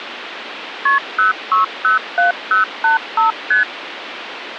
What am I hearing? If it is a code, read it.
Multi-frequency trunk signalling (R1, as on North American trunks), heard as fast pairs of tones, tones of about 130 ms, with phone line noise. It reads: KP 0607085 ST